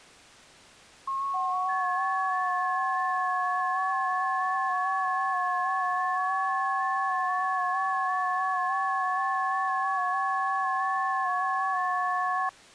FT8 (several signals at once), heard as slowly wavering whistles, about 6.25 baud.